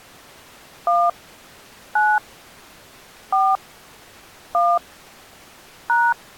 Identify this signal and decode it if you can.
DTMF, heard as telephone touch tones, dialled by hand, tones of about 230 ms. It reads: 1 9 4 1 #